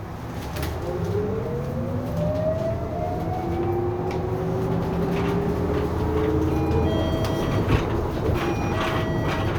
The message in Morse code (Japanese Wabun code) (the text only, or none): none